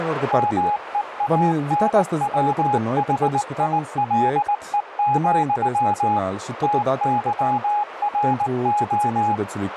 Morse code, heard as a keyed tone, machine-sent, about 19 wpm, 830 Hz, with radio static, a narrow filter and speech in Romanian. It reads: MEANWHILE, TYRO